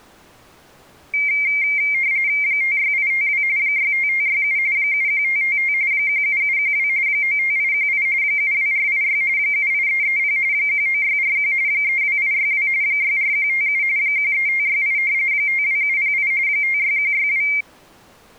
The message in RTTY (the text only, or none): 56852 65567 71555 17712 95818 72486 78330 19641 32862 64157 13568 52708 56162